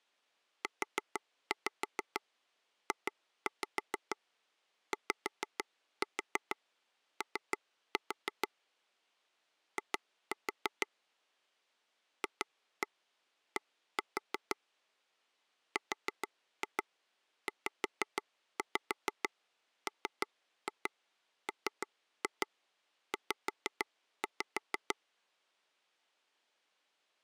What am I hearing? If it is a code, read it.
Tap code, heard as taps on a table, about 6 knocks a second. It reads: UJYO I FD RZMMZ